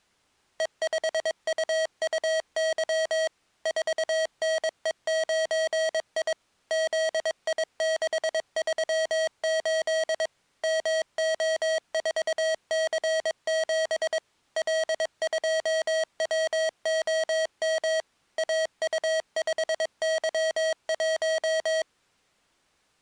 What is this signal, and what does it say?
Morse code, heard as electronic beeps, machine-sent, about 22 wpm, 640 Hz. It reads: E5UUY 4NE9I ZI638 MO4C7 L2WOM AU5Y1